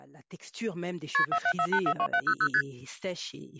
Multi-frequency trunk signalling (R1, as on North American trunks), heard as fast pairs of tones, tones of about 70 ms, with speech in French. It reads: KP 474842700 ST